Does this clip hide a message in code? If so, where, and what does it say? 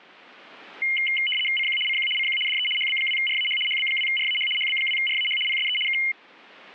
Yes: RTTY (75 baud, 850 Hz shift) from 0.8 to 6.1 s, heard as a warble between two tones, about 2550 Hz centre. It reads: CQ CQ CQ DE HB2RAH HB2RAH HB2RAH PSE K